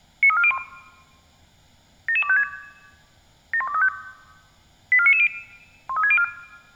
Five-tone selective call (ZVEI), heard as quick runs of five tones, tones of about 70 ms. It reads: 93401 77256 71235 84990 13604